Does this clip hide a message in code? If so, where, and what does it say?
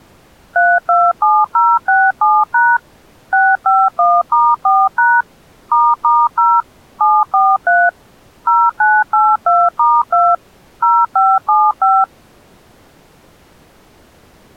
Yes: DTMF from 0.6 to 12.0 s, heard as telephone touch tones, dialled by machine, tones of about 230 ms. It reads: 327067# 651*4# **0 743 0982*2 0575